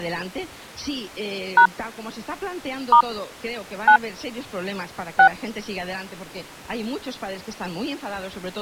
DTMF, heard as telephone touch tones, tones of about 90 ms. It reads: # * 9 6